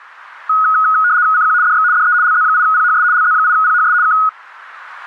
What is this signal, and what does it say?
RTTY (75 baud, 170 Hz shift), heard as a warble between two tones, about 1360 Hz centre. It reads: CQ DX DE LZ8PHS LZ8PHS K